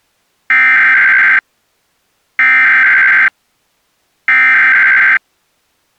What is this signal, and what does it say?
Emergency Alert System (SAME) tones (header bursts), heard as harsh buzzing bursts, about 520.83 baud.